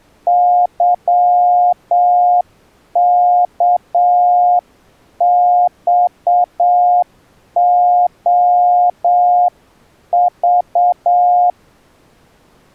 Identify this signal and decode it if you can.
Morse code, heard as a keyed tone, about 7 wpm, 710 Hz. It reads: YKXOV